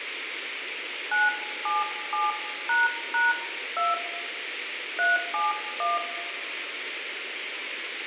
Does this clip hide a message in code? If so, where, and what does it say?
Yes: DTMF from 1.1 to 6.0 s, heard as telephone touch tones, dialled by hand, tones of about 180 ms, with radio hiss and room echo. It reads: 977##2 371